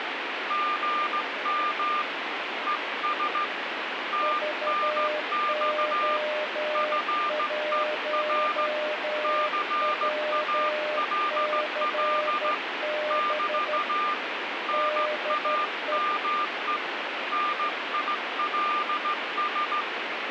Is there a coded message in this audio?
Yes: Morse code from 0.4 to 19.9 s, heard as two keyed tones, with radio static. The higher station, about 15 wpm, 1200 Hz: GM ES TNX FER CALL <BT> NAME NILS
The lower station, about 12 wpm, 610 Hz: VO1WCB DE